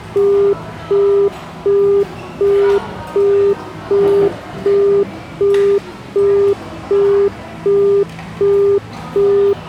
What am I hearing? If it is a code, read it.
Telephone call progress tone (as in the UK, Australia and similar networks), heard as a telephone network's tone, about 400 Hz, 0.375 s on and 0.375 s off, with the noise of a restaurant. Busy tone.